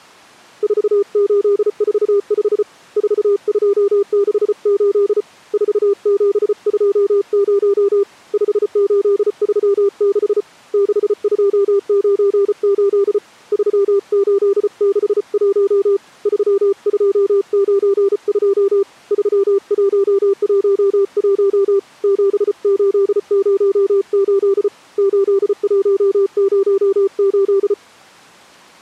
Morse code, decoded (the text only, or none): 4845 4268 4720 5836 6298 3861 3292 3111 7808 8108